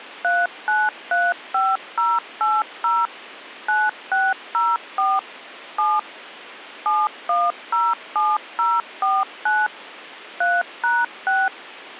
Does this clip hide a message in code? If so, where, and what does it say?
Yes: DTMF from 0.2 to 11.5 s, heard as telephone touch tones, dialled by machine, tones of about 210 ms. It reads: 3935080 9604 7 7107049 3#6